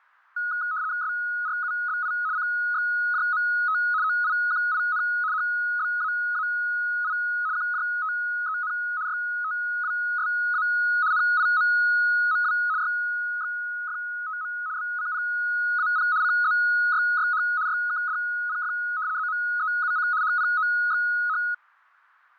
RTTY (75 baud, 170 Hz shift), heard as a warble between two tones, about 1360 Hz centre, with fading. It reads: SRUBI CXJMT OIQIN HBAAI QJTEN YTWSA NIMMW YXFTM BCPAP CZYYH YKDPF ZMEUC HPOXH